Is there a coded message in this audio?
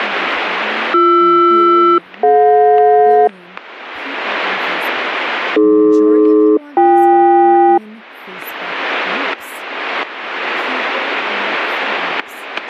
Yes: aircraft SELCAL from 0.9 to 7.8 s, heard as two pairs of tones, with static crashes and speech in English. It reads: BR-DJ AD-BK